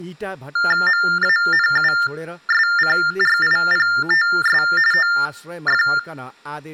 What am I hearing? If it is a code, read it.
TTY/TDD text telephone tones (45.45 baud Baudot), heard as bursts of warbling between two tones, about 400 Hz shift, 1600 Hz centre, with room echo and speech in Nepali. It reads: MANUSCRIPTS OF